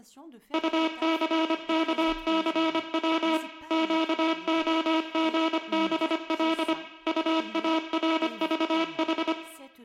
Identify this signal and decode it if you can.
Morse code, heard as a buzzer, machine-sent, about 25 wpm, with room echo and speech in French. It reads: UCKCW QOGBL UARVH